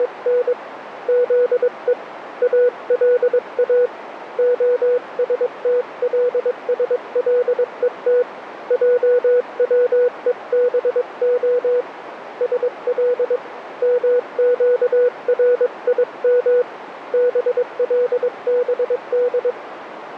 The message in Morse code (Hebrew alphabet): … זו אלא השתלשלות עצובה של מקרים בלבד

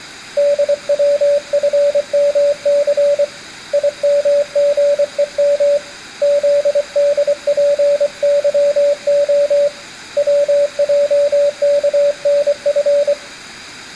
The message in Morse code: DWFMC IMGEM ZDPYO WJKNF

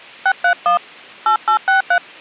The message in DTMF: 631 8863

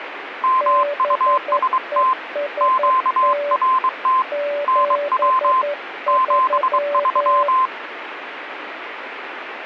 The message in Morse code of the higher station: MUST QRT NW 73

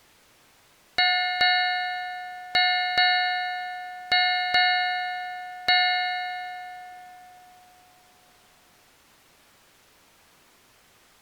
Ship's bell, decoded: 7

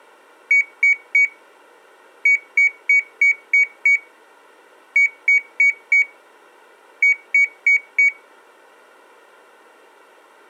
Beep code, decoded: 3-6-4-4

